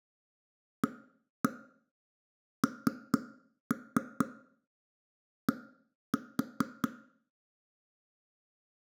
Tap code, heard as knocks on wood, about 4 knocks a second, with room echo. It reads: AND